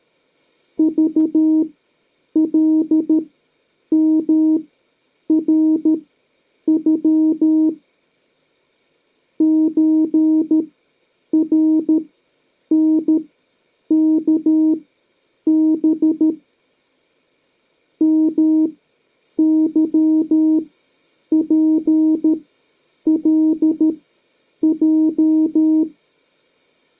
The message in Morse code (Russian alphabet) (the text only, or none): ЖЛМРЮ ЧРНКБ МЫПЛЙ